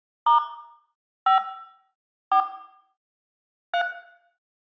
DTMF, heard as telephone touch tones, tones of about 110 ms, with room echo. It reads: * 5 4 3